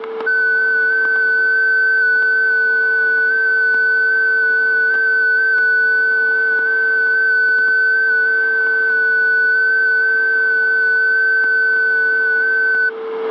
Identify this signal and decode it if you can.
FT8 (one signal), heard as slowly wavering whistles, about 6.25 baud, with static crashes and a steady whistle near 450 Hz.